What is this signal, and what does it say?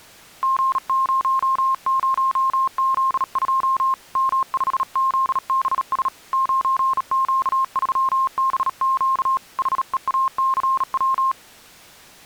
Morse code, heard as a keyed tone, hand-sent with a bug key, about 37 wpm, 1060 Hz. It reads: G00Z2 M5ZBS 9Q3BQ HEACW